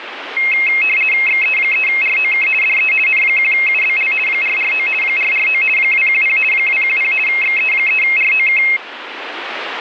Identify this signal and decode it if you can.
RTTY (50 baud, 450 Hz shift), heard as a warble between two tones, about 2350 Hz centre, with radio static. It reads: XE3ROK DE N1UBL 449 449 210 210 XE3ROK